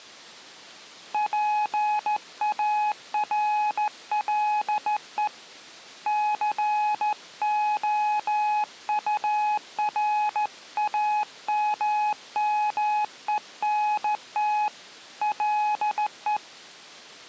Morse code, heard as a keyed tone, hand-sent with a straight key, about 14 wpm, 840 Hz. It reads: PARLE COURAMMENT LE